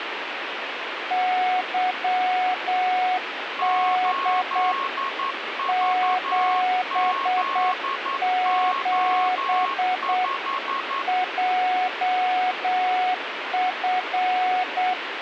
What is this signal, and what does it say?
Morse code, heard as two keyed tones, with radio static. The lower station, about 8 wpm, 740 Hz: YD 77 JF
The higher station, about 11 wpm, 1090 Hz: 8VZO5